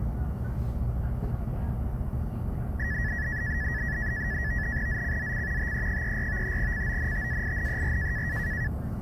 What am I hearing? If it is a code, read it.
NAVTEX (SITOR-B), 100 baud, 170 Hz shift, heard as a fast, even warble, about 1800 Hz centre, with the noise inside a bus. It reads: ZCZC TE34 CONTAINER